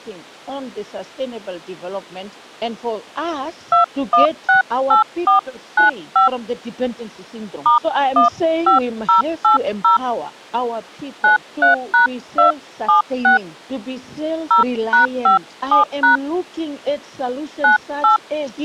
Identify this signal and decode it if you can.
DTMF, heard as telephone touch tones, dialled by hand, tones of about 130 ms. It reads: 2168495 *15080 93#276 0#57# 98